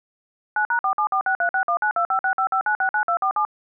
DTMF, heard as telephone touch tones, dialled by machine, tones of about 90 ms. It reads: 9#4746361925655969247